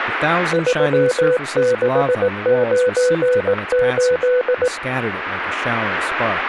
Morse code, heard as a keyed tone, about 18 wpm, 500 Hz, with speech in English. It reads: 3698